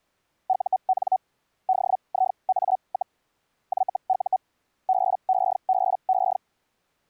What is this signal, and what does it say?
Hellschreiber (Feld-Hell, 122.5 baud), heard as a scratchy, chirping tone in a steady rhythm, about 750 Hz. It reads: UN DIA, YU BEBE